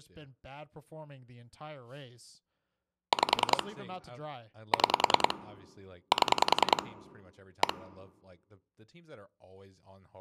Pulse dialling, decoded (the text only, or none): 5 6 7 1